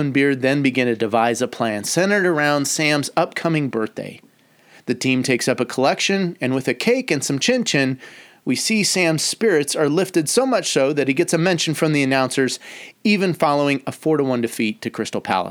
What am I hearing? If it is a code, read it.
Speech in English. There is no code.